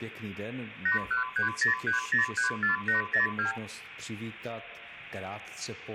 Multi-frequency trunk signalling (R2, with the far end's replies), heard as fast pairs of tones, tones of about 130 ms, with phone line noise and room echo. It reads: 81303034802